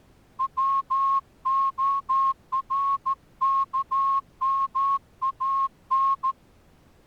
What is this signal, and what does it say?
Morse code, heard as a whistle, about 14 wpm. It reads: WORKMAN